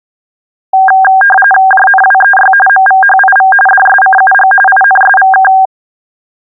RTTY (45.45 baud, 850 Hz shift), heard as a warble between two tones, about 1190 Hz centre. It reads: JNWEY MVHIV DSCUG INSVK